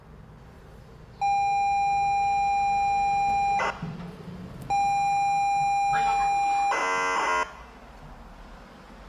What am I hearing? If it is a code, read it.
ZX Spectrum tape loading, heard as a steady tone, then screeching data, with room echo and the noise inside a lift.